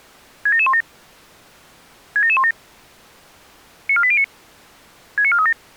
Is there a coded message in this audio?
Yes: five-tone selective call (ZVEI) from 0.5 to 5.5 s, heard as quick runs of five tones, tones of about 70 ms. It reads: 67717 67717 94809 69437